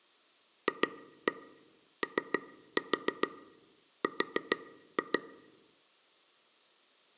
Tap code, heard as taps on a table, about 6 knocks a second, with room echo. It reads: FOR